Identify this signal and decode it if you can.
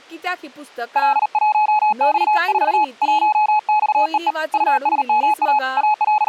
Morse code, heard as a keyed tone, hand-sent with a paddle, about 38 wpm, 850 Hz, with speech in Goan Konkani. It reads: L1X4 1XEE USMA …